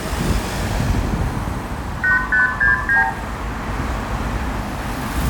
Multi-frequency trunk signalling (R2, with the far end's replies), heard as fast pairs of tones, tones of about 140 ms, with room echo and street noise. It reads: 8569